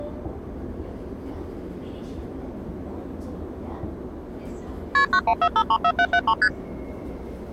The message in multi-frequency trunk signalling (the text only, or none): KP 914534773 ST